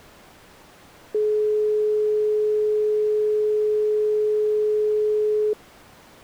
Telephone call progress tone (425 Hz plan, as in most of Europe), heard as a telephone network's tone, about 420 Hz. Dial tone.